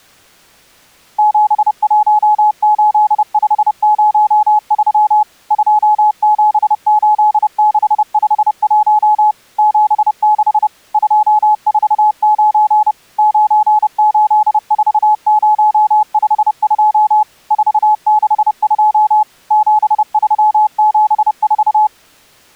Morse code, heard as a keyed tone, machine-sent, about 30 wpm, 850 Hz. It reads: 718503 278651 76 249 984052 462 7374